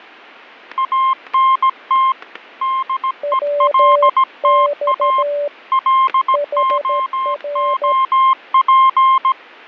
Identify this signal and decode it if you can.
Morse code, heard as two keyed tones, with fading and static crashes. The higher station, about 17 wpm, 1060 Hz: ANT DELTA LOOP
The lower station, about 13 wpm, 580 Hz: WX HR